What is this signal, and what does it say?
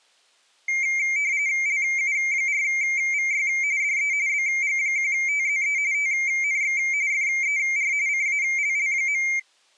RTTY (45.45 baud, 170 Hz shift), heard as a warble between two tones, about 2200 Hz centre. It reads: LU4VY DE BG1TZE TNX FER CALL.